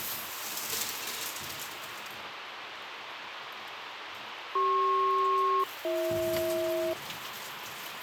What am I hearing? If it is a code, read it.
Aircraft SELCAL, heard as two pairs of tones, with radio hiss and kitchen noise. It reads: CP-BH